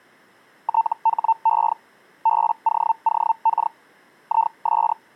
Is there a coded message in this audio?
Yes: Hellschreiber (Feld-Hell, 122.5 baud) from 0.6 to 4.9 s, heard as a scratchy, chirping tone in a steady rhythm, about 900 Hz. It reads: THE BOOK IS